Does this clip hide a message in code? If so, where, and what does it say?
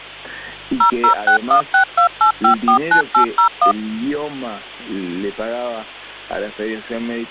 Yes: DTMF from 0.8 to 3.7 s, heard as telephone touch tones, dialled by machine, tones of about 100 ms. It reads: 0061628549801